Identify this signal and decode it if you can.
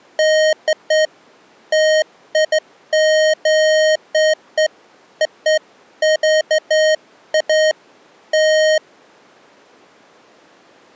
Beeps of irregular length. There is no code.